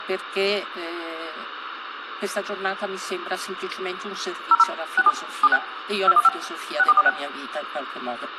DTMF, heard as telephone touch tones, dialled by machine, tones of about 40 ms, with phone line noise. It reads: 00 67 76 215 6446